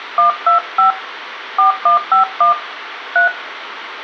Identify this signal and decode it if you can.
DTMF, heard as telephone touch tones, dialled by hand, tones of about 120 ms, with radio hiss and room echo. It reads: 125 4151 3